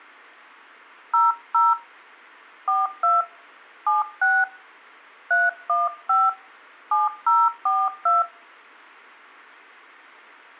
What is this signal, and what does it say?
DTMF, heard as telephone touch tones, dialled by hand, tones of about 190 ms. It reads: 00 42 76 315 7042